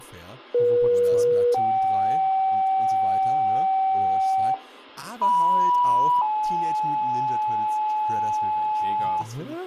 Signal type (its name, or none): two-tone page